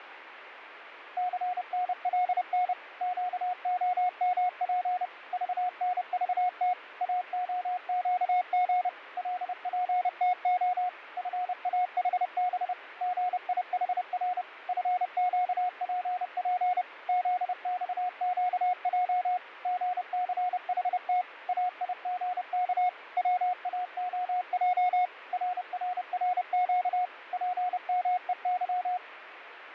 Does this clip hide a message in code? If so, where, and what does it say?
Yes: Morse code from 1.1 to 29.0 s, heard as a keyed tone, machine-sent, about 30 wpm, 720 Hz, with radio static and fading. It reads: CNLN QOMP VNVT AOQG LPTO FAHB GIHR FQPP ZXQJ GCHT AIGK WAOJ RRRQ PMEY